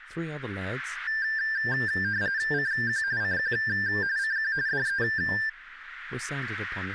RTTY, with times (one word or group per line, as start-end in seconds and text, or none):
2.5-3.0 CQ
3.2-3.5 CQ
4.2-4.5 CQ
4.7-5.0 DE